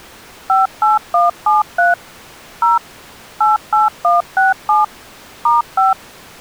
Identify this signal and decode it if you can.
DTMF, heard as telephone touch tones, dialled by machine, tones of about 160 ms. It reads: 58173 0 88167 *5